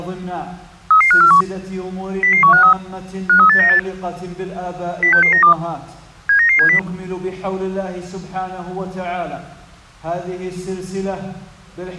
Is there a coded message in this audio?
Yes: five-tone selective call (CCIR) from 0.9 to 6.8 s, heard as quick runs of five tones, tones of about 100 ms. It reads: 33541 00153 53898 06692 79970